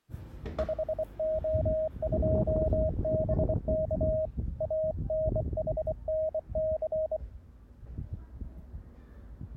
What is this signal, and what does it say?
Morse code, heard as a keyed tone, hand-sent with a bug key, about 24 wpm, 630 Hz, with the noise of a residential street. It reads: 5O2BK ANHNC